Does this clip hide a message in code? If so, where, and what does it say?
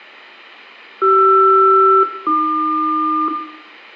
Yes: aircraft SELCAL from 1.0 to 3.3 s, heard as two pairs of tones, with room echo. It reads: CR-AQ